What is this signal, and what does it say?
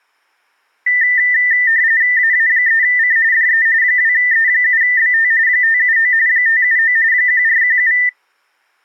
RTTY (45.45 baud, 170 Hz shift), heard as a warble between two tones, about 1900 Hz centre. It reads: AA3C DE 2E7BT 579 579 1417